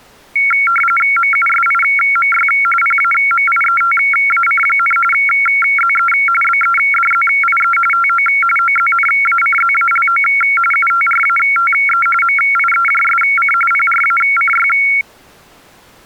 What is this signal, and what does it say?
RTTY (45.45 baud, 850 Hz shift), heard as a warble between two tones, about 1800 Hz centre. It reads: MUSIMY PAMIETAC, ZE BEDZIE TO OZNACZALO UTRATE MIEJSC PRACY